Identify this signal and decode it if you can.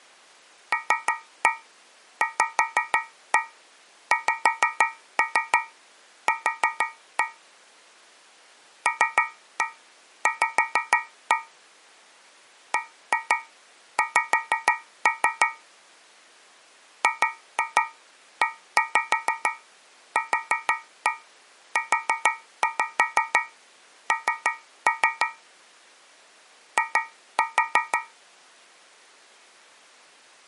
Tap code, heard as taps on a metal pipe, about 6 knocks a second. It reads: LVXQ LV BX GEQUN I